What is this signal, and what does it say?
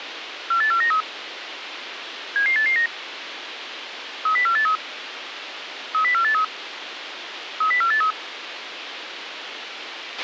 Five-tone selective call (CCIR), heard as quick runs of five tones, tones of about 100 ms, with radio hiss and a squelch burst at the end. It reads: 48493 77889 30483 30483 30483